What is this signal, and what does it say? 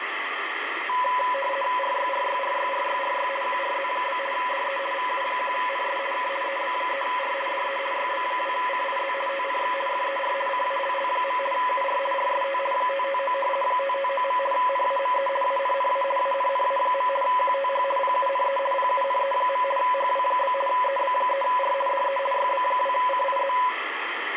RTTY (50 baud, 450 Hz shift), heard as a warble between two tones, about 780 Hz centre, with radio static. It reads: RYRYRYRYRY QRZ? DE VU1NS K EB3R DE YB2CIZ TNX FER CALL. UR RST 559 559. NAME ANNA ANNA. QTH PUNE PUNE. HW? EB3R DE YB2CIZ